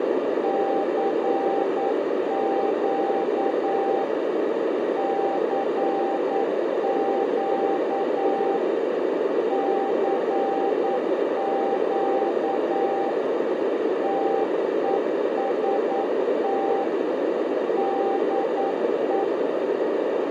Morse code, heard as a keyed tone, machine-sent, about 9 wpm, 790 Hz, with heavy radio static and a narrow filter. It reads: CQ CQ CQ TEST DE